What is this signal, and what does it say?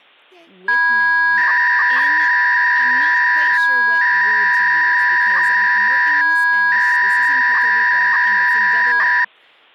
300-baud modem data (V.21 tones), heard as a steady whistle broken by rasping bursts, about 300 baud, 200 Hz shift, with speech in English.